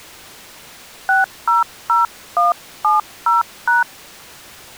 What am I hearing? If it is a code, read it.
DTMF, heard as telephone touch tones, dialled by hand, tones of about 150 ms. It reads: 600170#